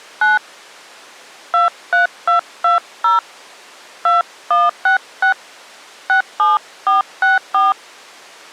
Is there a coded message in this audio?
Yes: DTMF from 0.2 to 7.7 s, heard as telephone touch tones, dialled by hand, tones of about 150 ms. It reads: 9 23220 2166 67464